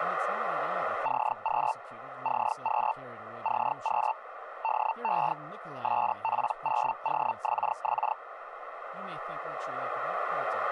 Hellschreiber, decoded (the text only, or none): CQ CQ CQ DE SP0OXX